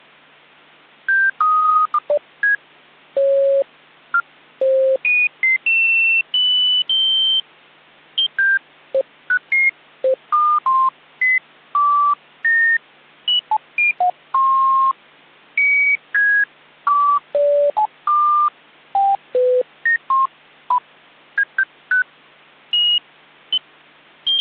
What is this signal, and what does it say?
Electronic bleeps of random pitch and length. There is no code.